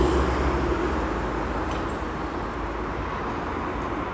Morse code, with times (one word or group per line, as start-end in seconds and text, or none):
none